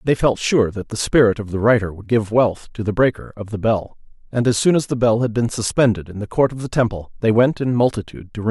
Speech in English. There is no code.